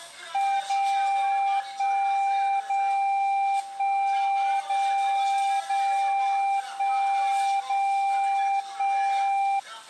Radio time signal (DCF77), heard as a tone whose level steps once a second, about 790 Hz, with the noise of a crowd indoors. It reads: 0 1 0 1 0 0 1 0 1